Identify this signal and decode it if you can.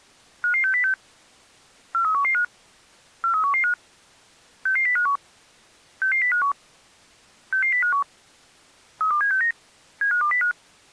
Five-tone selective call (CCIR), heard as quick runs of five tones, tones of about 100 ms. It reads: 55606 43115 43115 66051 66051 66051 32769 75205